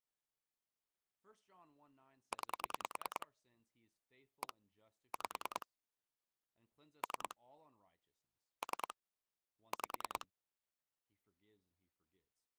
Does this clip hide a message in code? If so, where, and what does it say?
Yes: pulse dialling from 2.3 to 10.2 s, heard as clicks on a phone line, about 10 pulses a second, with speech in English. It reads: 9 1 5 3 3 5